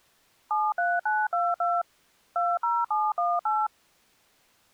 DTMF, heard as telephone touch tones, dialled by machine, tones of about 220 ms. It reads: 73922 20718